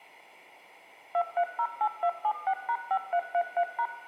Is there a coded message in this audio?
Yes: DTMF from 1.1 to 3.9 s, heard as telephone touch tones, dialled by machine, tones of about 70 ms, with room echo. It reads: 2308276#5333#